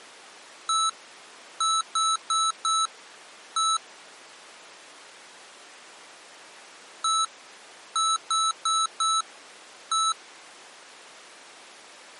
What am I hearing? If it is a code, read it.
Beep code, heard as beeps from a small speaker, played twice, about 1310 Hz. 1-4-1. In Phoenix BIOS tables: address line failure in the first 64 KB of memory.